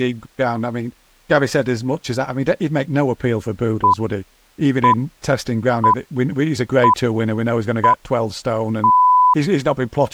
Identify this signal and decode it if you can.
Radio time signal (six pips, as the Greenwich Time Signal), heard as pips, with speech in English.